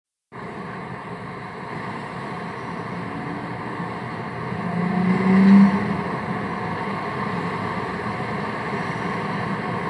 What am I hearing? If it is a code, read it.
Street noise. There is no code.